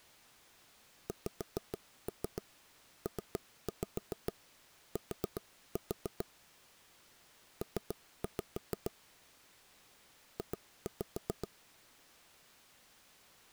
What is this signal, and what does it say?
Tap code, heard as knocks on wood, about 7 knocks a second. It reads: XPT P J